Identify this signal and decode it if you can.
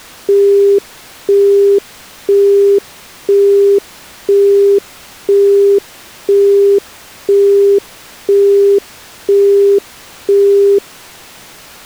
Telephone call progress tone (single-tone plan, as in Europe, Japan and elsewhere), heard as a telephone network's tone, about 400 Hz, 0.5 s on and 0.5 s off. Busy tone.